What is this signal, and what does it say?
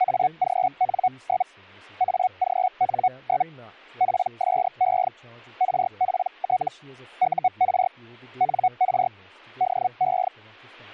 Hellschreiber (Feld-Hell, 122.5 baud), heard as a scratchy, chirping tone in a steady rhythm, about 740 Hz, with speech in English. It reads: AGN? AGN? PSE RPT UR NR DE